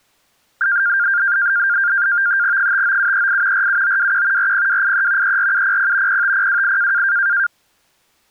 NAVTEX (SITOR-B), 100 baud, 170 Hz shift, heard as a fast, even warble, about 1500 Hz centre. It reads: 59738 47921 40283 34700 05028